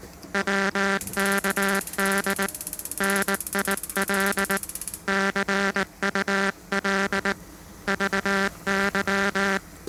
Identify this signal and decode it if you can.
Morse code, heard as a buzzer, hand-sent with a paddle, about 19 wpm, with kitchen noise. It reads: WKD NIL CUL VY